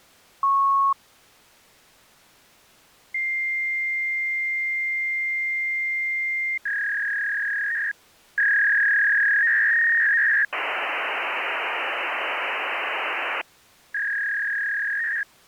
Fax machine handshake, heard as a beep, a long tone, a warble and hiss.